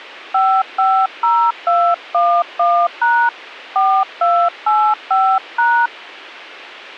DTMF, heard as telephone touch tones, dialled by hand, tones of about 280 ms. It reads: 550211# 4285#